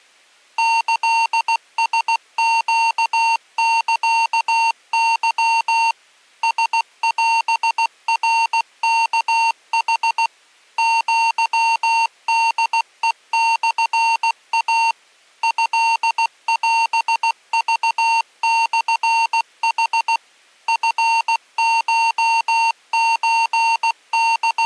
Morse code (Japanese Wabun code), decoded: キラネサケ ラオナワヌ アホヘモイ トオクモヌ …

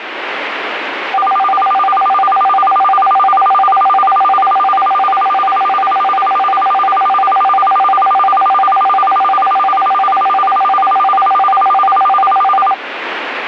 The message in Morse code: none

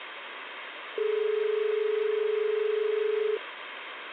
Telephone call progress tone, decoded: dial tone

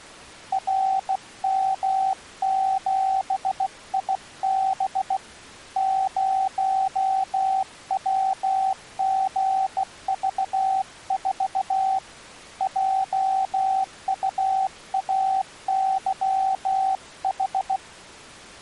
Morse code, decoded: RM7IB 0WGV4 JUAYH

